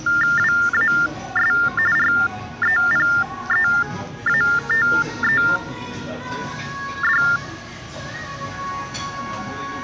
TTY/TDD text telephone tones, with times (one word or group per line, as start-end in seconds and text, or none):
0.4-1.5 WAS
2.0-7.2 REPEATED